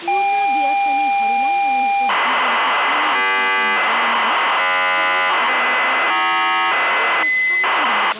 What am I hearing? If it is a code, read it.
ZX Spectrum tape loading, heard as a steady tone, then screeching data, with tape hiss and speech in Nepali.